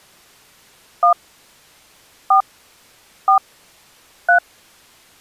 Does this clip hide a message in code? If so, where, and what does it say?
Yes: DTMF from 1.0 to 4.4 s, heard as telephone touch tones, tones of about 100 ms. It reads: 1 4 4 3